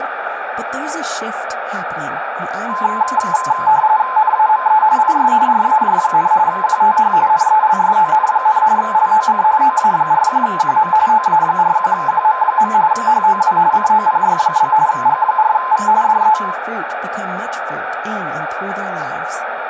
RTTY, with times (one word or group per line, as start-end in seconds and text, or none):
4.2-4.8 NAME
5.0-5.3 IS
5.5-6.3 RAJ,
6.5-7.1 QTH
7.3-8.6 NELSON,
8.8-9.4 LOC
9.6-10.9 OA41QM
11.1-12.7 OA41QM.
12.9-13.6 HOW
13.7-14.7 COPY?
14.9-15.9 G4V
16.0-16.4 DE